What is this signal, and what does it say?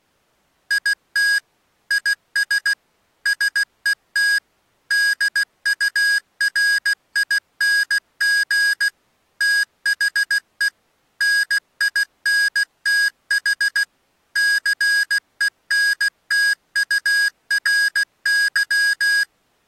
Morse code, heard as electronic beeps, machine-sent, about 16 wpm, 1650 Hz. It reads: IT IS SET DURING THE NINTH CENTURY